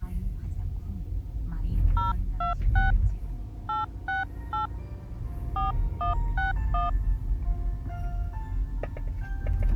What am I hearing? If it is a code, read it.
DTMF, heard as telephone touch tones, dialled by hand, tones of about 130 ms, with the noise inside a car. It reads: 026 868 4161